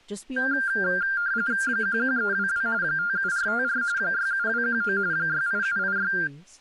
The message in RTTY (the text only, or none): 11322 57454 67219 68786